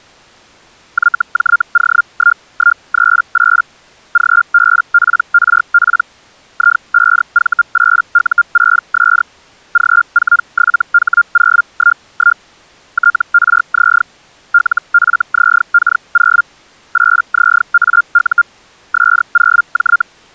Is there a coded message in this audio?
Yes: Hellschreiber (Feld-Hell, 122.5 baud) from 0.9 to 20.0 s, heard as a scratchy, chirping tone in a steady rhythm, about 1400 Hz. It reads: YJO1138 GBPRP I5V8U6S G47H011 TRZ LFZK0 8ZAU S0J